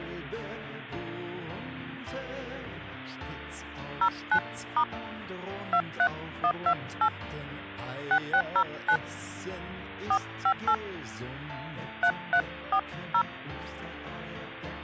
DTMF, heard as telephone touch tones, dialled by hand, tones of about 70 ms. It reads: 09* 23128 6609 458 3340